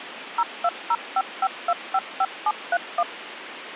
DTMF, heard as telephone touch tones, dialled by machine, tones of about 50 ms, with phone line noise. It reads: 02055255731